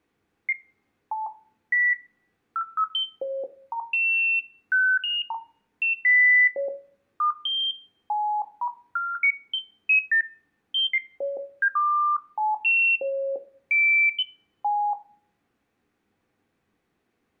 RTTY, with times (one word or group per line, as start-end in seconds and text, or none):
none